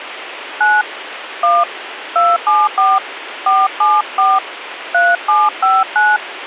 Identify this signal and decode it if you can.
DTMF, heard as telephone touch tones, dialled by hand, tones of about 210 ms, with radio hiss. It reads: 9 1 274 474 3759